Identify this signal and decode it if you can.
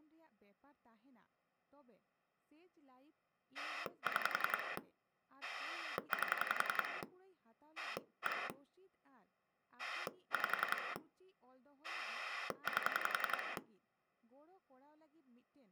Pulse dialling, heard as a rotary dial, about 11 pulses a second, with speech in Santali. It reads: 6 8 1 5 8